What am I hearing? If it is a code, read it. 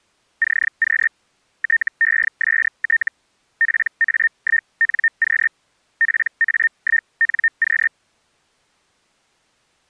Hellschreiber (Feld-Hell, 122.5 baud), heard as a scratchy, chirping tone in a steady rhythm, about 1800 Hz. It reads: CQ TEST PA1NQ PA1NQ